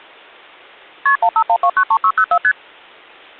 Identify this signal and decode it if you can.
Multi-frequency trunk signalling (R1, as on North American trunks), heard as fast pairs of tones, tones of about 70 ms. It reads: KP 151293604 ST